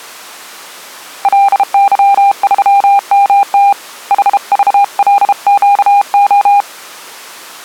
Morse code, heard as a keyed tone, hand-sent with a bug key, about 32 wpm, 800 Hz. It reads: LY3MT HVLQO